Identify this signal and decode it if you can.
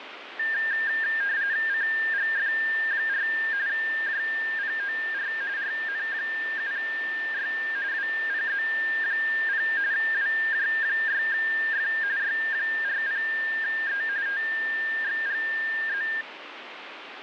RTTY (45.45 baud, 170 Hz shift), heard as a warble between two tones, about 1700 Hz centre, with radio static. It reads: CGF4 JPOR RN7Y WPZ0 WJ6F Y40E TXGZ